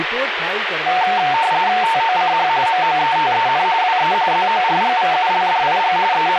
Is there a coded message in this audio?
Yes: RTTY (45.45 baud, 170 Hz shift) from 0.9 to 6.4 s, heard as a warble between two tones, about 820 Hz centre, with radio static and speech in Gujarati. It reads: TOCH MOETEN WE ZORGVULDIG …